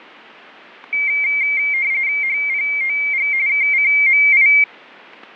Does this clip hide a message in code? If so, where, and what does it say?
Yes: RTTY (45.45 baud, 170 Hz shift) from 0.9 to 4.6 s, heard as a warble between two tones, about 2200 Hz centre. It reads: HPOG KCMI